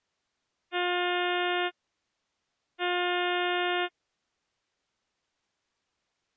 Ship horn signal, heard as a ship's horn, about 360 Hz. 2 short. At sea: I am altering course to port.